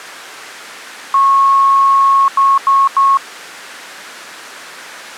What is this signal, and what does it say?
Beep code, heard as beeps, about 1100 Hz. 1 long, 3 short. In Award and IBM BIOS tables: video adapter failure; in AMI BIOS tables: memory failure.